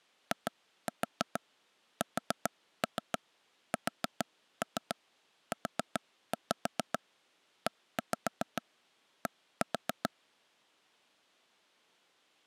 Tap code, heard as taps on a table, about 6 knocks a second. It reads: ISSUED